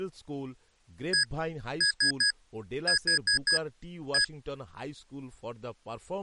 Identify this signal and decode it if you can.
Beep code, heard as beeps from a small speaker, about 1650 Hz, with speech in Bangla. 1-3-4-1. In Phoenix BIOS tables: memory failure on an address line.